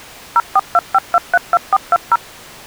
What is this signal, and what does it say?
DTMF, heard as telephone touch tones, dialled by machine, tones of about 40 ms. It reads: 0425232420